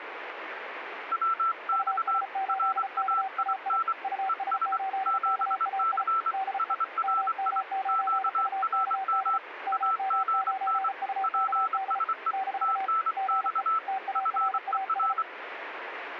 Morse code, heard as two keyed tones, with radio static. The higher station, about 24 wpm, 1330 Hz: WX RAIN ES 7C SRI QRM AGN PSE TNX FER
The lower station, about 34 wpm, 760 Hz: US8KAI US8KAI DE MM9UKD MM9UKD - GE TARAS